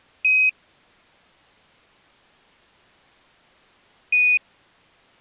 Quindar tones, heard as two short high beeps.